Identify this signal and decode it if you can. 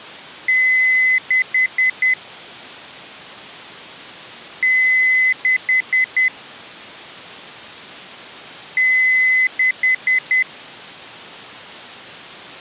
Beep code, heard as beeps from a small speaker, played three times, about 2050 Hz. 1 long, 4 short.